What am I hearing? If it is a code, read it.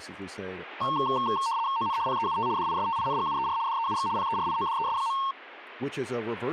RTTY (75 baud, 170 Hz shift), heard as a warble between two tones, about 1000 Hz centre, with speech in English. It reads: ON PEUT DISTINGUER DEUX PERIODES.